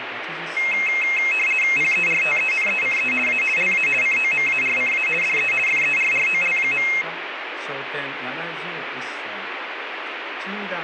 RTTY (50 baud, 450 Hz shift), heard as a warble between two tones, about 2350 Hz centre, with radio static. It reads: PERTENECE A LA COMARCA DE FERROL.